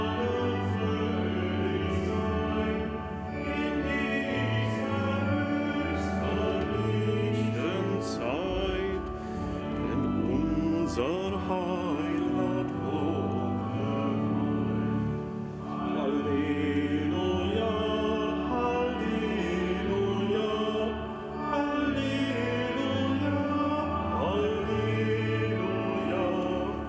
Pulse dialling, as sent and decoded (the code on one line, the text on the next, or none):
none